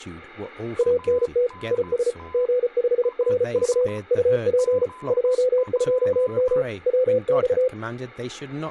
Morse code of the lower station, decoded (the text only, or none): ANT IS G5RV UP 22M WX